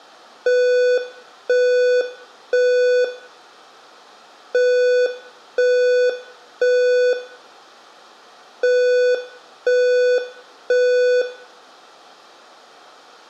Alarm pattern, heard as an alarm's beeps, played three times, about 500 Hz, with room echo. Temporal three. Smoke or fire, evacuate.